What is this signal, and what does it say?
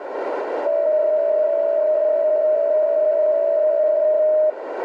PSK63 (62.5 baud), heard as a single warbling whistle, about 620 Hz, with radio static and a narrow filter.